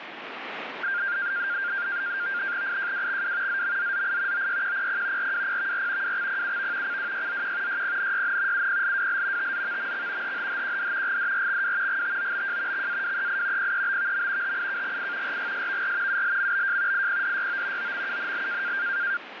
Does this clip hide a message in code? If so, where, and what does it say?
Yes: NAVTEX (SITOR-B), 100 baud, 170 Hz shift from 0.8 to 19.2 s, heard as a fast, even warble, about 1500 Hz centre, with radio static. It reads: IJWXW ZMZZI OYQPP RWPVR WXPUV CWYZQ YPNYN UPLWL TZVMX HHHQD GDRXW GTOBJ XAWEI PEBVM HIKGI RGSVR ULMBJ IPDYO OMUNL